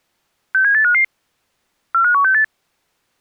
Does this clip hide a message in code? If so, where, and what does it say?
Yes: five-tone selective call (CCIR) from 0.5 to 2.4 s, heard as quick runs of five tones, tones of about 100 ms. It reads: 67855 45168